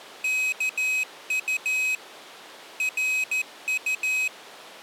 Morse code, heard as a high beeper, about 13 wpm, 2550 Hz. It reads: KU RU